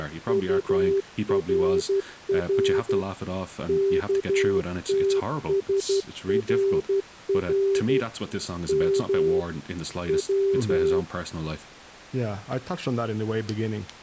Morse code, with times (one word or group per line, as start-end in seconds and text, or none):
0.0-3.0 …
3.7-8.0 KTSRR
8.7-9.4 M
10.1-11.0 W